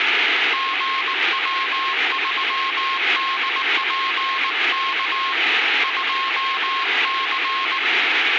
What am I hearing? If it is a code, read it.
Morse code, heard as a keyed tone, hand-sent with a paddle, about 19 wpm, 1070 Hz, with radio static. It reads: GW3DPK 2C